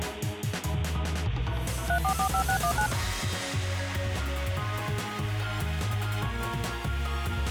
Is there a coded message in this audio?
Yes: DTMF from 1.9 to 2.9 s, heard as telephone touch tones, dialled by machine, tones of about 90 ms. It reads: 3445619